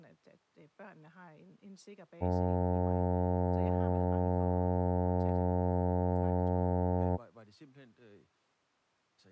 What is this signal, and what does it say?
Ship horn signal, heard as a ship's horn, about 90 Hz, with speech in Danish. 1 long. At sea: a vessel nearing a blind bend, or under power and making way in fog.